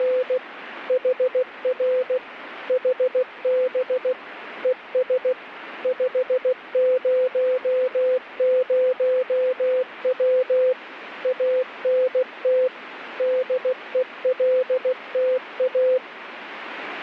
Morse code, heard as a keyed tone, machine-sent, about 16 wpm, 510 Hz, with radio static. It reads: … HR HB ES 500W ANT DELTA